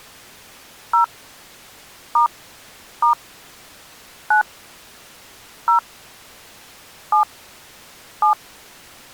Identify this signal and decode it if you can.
DTMF, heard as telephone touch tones, dialled by hand, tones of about 110 ms. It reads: 0 * * 9 0 7 7